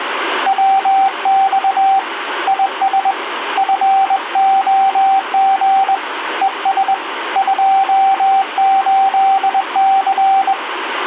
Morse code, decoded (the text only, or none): WX IS FOG ES 28C